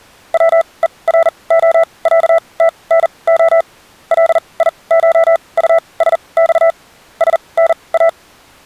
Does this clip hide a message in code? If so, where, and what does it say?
Yes: Morse code (Russian alphabet) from 0.3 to 8.2 s, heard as a keyed tone, machine-sent, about 40 wpm, spaced as for 26 wpm, 660 Hz. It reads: ВЕРОЯТНО ЛИШУСЬ СНА